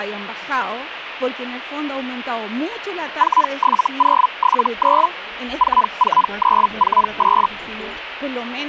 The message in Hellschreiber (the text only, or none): 47079 44948